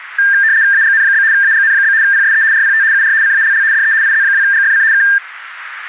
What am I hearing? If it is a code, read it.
RTTY (75 baud, 170 Hz shift), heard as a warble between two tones, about 1700 Hz centre, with radio static. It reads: AGN? AGN? PSE RPT UR CALL DE IZ2GFC K